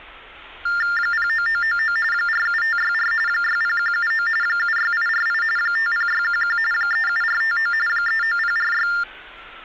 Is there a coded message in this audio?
Yes: TTY/TDD text telephone tones (45.45 baud Baudot) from 0.7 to 9.0 s, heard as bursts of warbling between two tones, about 400 Hz shift, 1600 Hz centre, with hum and street noise. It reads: 09999 47564 60179 76848 50611 37459 39046